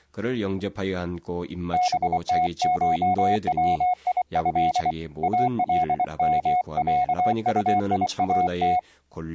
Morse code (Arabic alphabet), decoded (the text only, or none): بتشويه المعطيات